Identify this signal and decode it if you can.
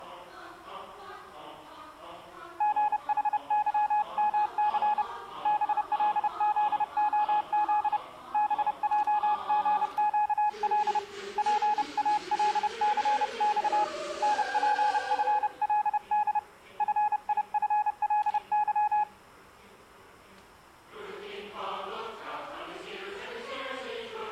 Morse code, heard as a keyed tone, hand-sent with a paddle, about 30 wpm, 840 Hz. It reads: GHYMC BLZOZ BJGQL PALCX NPFLD FIFLY